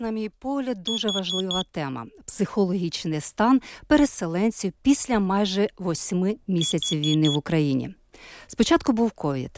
Alarm pattern, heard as an alarm's beeps, played twice, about 3350 Hz, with speech in Ukrainian. Temporal four. Carbon monoxide.